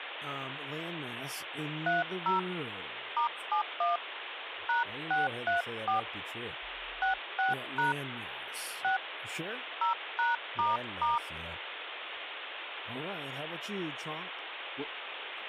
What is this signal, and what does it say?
DTMF, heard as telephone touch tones, dialled by hand, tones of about 140 ms, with phone line noise and speech in English. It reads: 30 *71 #634 66# 6 0#**